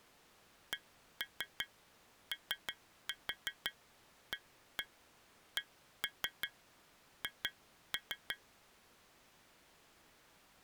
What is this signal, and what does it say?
Tap code, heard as taps on glass, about 5 knocks a second. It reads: COACH